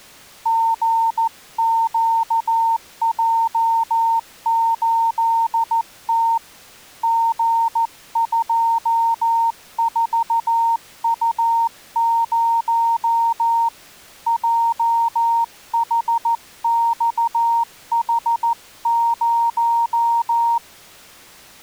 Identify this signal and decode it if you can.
Morse code, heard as a keyed tone, hand-sent with a paddle, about 14 wpm, 920 Hz. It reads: GQJ8T G24U0 JHXH0